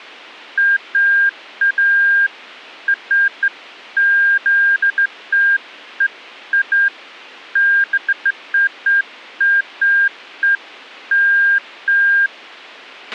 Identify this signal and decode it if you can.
Beeps of irregular length, with a squelch burst at the end. There is no code.